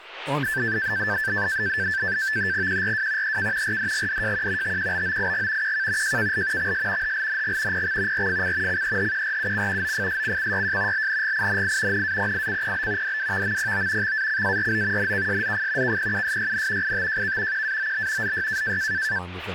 NAVTEX (SITOR-B), 100 baud, 170 Hz shift, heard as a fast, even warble, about 1650 Hz centre, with speech in English. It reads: QRW EK RDGDJQ TQBOIG QK JKL XS HLNG PX RFC CEHQRUC OFSCCYJ LNGINI NAPICPB DWVMPO XACARO NKSZF KPUSYN ITJK QAOB ZY